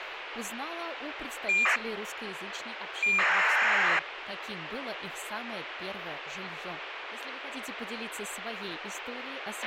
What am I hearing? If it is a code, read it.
ACARS aircraft data, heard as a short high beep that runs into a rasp, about 2400 baud, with radio hiss and a squelch burst at the end.